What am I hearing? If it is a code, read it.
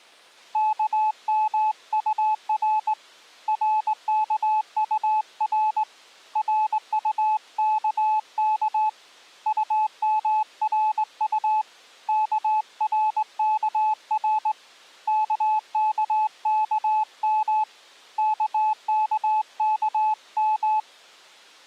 Morse code, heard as a keyed tone, hand-sent with a straight key, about 19 wpm, 860 Hz. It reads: KMUR RKUR RUKK UMRU KRKR KKKM KKKM